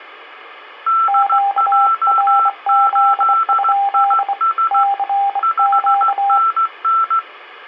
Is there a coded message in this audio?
Yes: Morse code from 0.8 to 7.2 s, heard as two keyed tones. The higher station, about 16 wpm, 1340 Hz: DJ8IS 5NN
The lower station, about 24 wpm, 800 Hz: QRZ? CQ